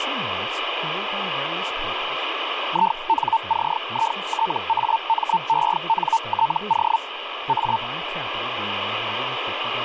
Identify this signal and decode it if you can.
Hellschreiber (Feld-Hell, 122.5 baud), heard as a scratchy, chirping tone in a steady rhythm, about 900 Hz, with radio static and speech in English. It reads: INCITAMENTO A